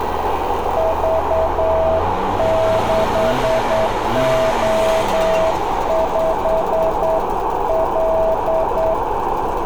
Morse code, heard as a keyed tone, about 9 wpm, 650 Hz, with radio static, a narrow filter, room echo and street noise. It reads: V6O5L